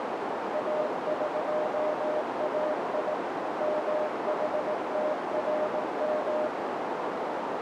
Morse code (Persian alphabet), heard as a keyed tone, machine-sent, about 18 wpm, 610 Hz, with heavy radio static and a narrow filter. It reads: اقای محترم